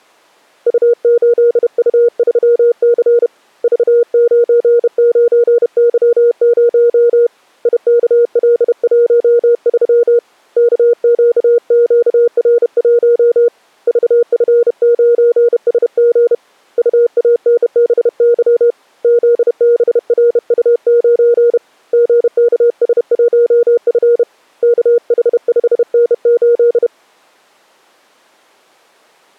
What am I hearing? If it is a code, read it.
Morse code, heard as a keyed tone, hand-sent with a bug key, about 31 wpm, 470 Hz. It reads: U8U3C V99Y0 IKL13 KQQR1 VF9SG UANBY ZBRU9 GKS1F KH5N8